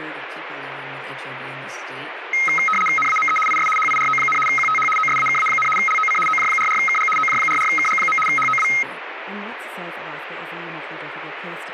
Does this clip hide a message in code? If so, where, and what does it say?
Yes: RTTY (75 baud, 850 Hz shift) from 2.3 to 8.8 s, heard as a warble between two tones, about 1700 Hz centre, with radio static. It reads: NAME IS HIRO, QTH OSAKA, LOC OJ44KG OJ44KG. HOW